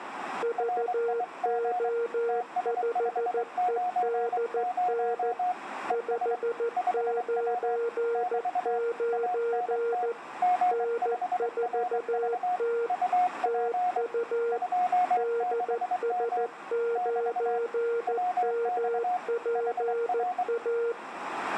Morse code, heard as two keyed tones. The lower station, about 14 wpm, 470 Hz: VO5EDN 599 N4T TU DS9MPA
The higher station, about 23 wpm, 720 Hz: RIG TS590 ES 5W <BT> ANT G5RV UP 26M <BT> WX HR